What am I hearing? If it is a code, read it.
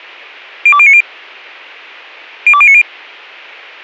Five-tone selective call (ZVEI), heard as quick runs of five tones, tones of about 70 ms. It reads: 02090 02090